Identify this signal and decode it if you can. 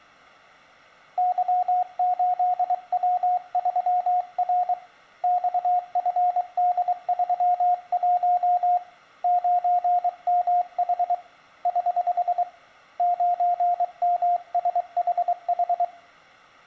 Morse code, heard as a keyed tone, hand-sent with a paddle, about 23 wpm, 710 Hz, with room echo. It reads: Y8W3R XFD31 9MH <HH> 9MSHH